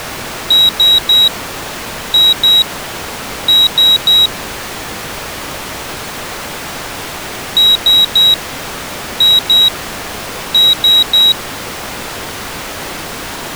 Beep code, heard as a piezo beeper, played twice, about 3850 Hz. 3-2-3.